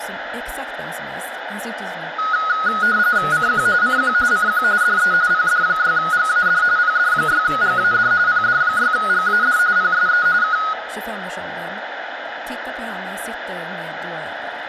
RTTY (45.45 baud, 170 Hz shift), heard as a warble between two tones, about 1360 Hz centre, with radio static, room echo and speech in Swedish. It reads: CQ CQ CQ DE PD6GAD PD6GAD PD6GAD PSE K